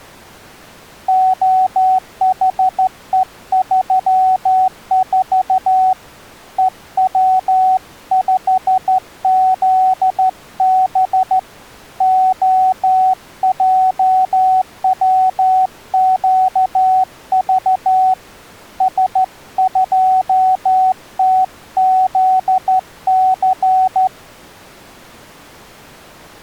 Morse code, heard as a keyed tone, hand-sent with a straight key, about 13 wpm, 750 Hz. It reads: OHE34 EW5ZB OJWQV S2TZC